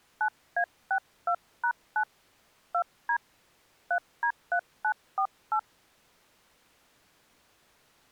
DTMF, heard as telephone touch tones, dialled by hand, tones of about 80 ms. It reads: 9A62#9 2D 3D3948